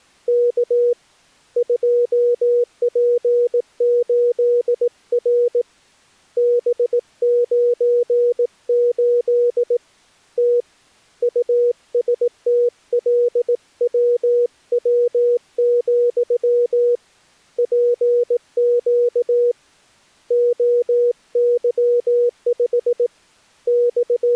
Morse code, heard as a keyed tone, hand-sent with a paddle, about 18 wpm, 480 Hz. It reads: K 2P8R B98 T USTLWW, PQ OY5 …